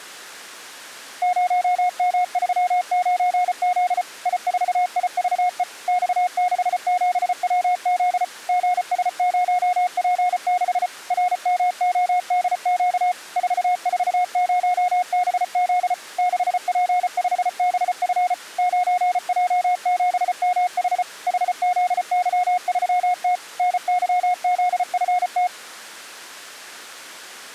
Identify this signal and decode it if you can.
Morse code, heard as a keyed tone, machine-sent, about 34 wpm, 720 Hz. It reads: 0M39Z I4IVE X67WZ GS0P6 RMODQ 440BZ 6P5BF 9J7MH HZY3T NYZFT